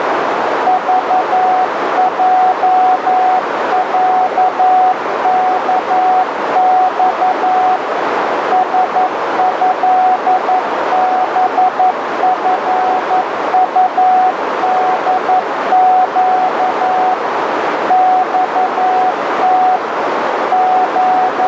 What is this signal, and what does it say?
Morse code (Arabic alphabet), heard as a keyed tone, machine-sent, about 11 wpm, 740 Hz, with heavy radio static and a narrow filter. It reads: ضجعكص سهبفطدق صت …